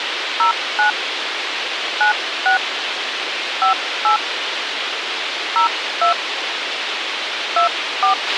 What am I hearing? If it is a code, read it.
DTMF, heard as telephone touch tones, dialled by hand, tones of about 110 ms, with radio hiss and a squelch burst at the end. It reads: 09 96 58 02 24